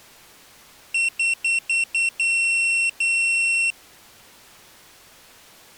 Beep code, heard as a piezo beeper, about 2700 Hz. 5 short, 2 long.